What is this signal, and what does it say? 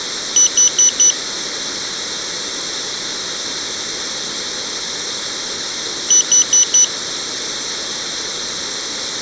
Alarm pattern, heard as an alarm's beeps, played twice, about 3000 Hz, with room echo. Temporal four. Carbon monoxide.